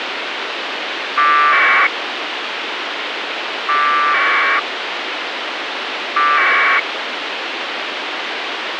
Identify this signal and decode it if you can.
Packet radio (AX.25, as in APRS), 1200 baud, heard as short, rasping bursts, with radio hiss and a squelch burst at the end.